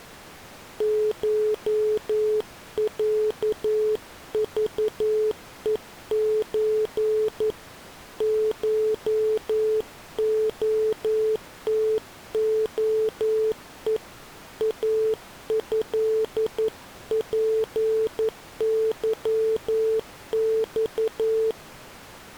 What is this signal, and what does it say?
Morse code (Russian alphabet), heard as a keyed tone, hand-sent with a paddle, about 11 wpm, 440 Hz. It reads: ШЯЖЕЧ ШОТОЕ АЭПЫЬ